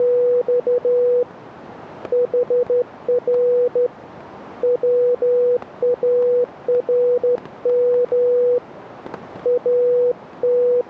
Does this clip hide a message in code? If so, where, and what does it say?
Yes: Morse code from 0.0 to 10.9 s, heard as a keyed tone, hand-sent with a straight key, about 13 wpm, 490 Hz, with static crashes. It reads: … HR WARM …